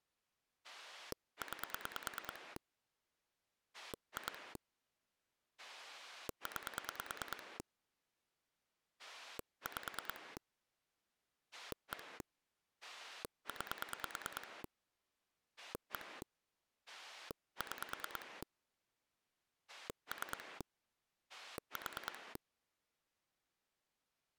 Pulse dialling, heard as a rotary dial, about 9 pulses a second. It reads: 9 2 9 5 1 9 1 6 3 4